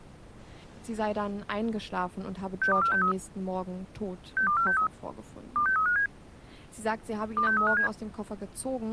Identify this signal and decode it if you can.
Five-tone selective call (CCIR), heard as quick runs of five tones, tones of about 100 ms, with speech in German. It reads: 62463 62463 26357 26357